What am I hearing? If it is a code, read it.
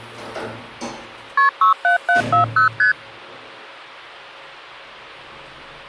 Multi-frequency trunk signalling (R1, as on North American trunks), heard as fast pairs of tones, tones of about 120 ms, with the noise inside a lift. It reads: KP 67740 ST